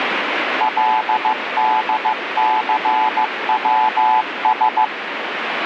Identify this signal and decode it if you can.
Morse code, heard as a keyed tone, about 15 wpm, 870 Hz, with radio static. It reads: LDCWS